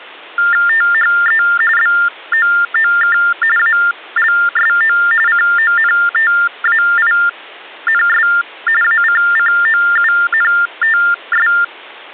TTY/TDD text telephone tones (45.45 baud Baudot), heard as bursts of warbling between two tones, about 400 Hz shift, 1600 Hz centre. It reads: THE BOOK ALSO CONTAINS ACCOUNTS